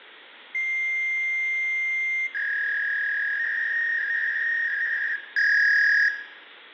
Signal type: fax machine handshake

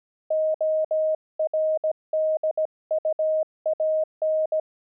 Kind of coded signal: Morse code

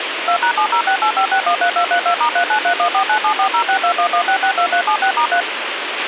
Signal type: DTMF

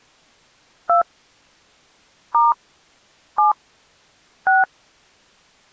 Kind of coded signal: DTMF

